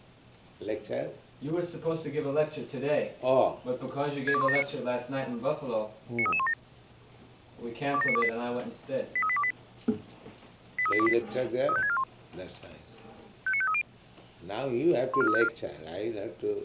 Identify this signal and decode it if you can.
Five-tone selective call (ZVEI), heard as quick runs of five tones, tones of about 70 ms. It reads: 62179 93317 27928 83828 83828 35641 59530 14354